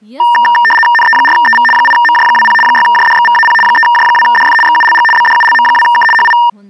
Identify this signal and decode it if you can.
RTTY (75 baud, 850 Hz shift), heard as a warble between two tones, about 1380 Hz centre, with speech in Nepali. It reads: NE4EV 8MJ20 6JDXVAP 3J2DF XULG BDULM2K HI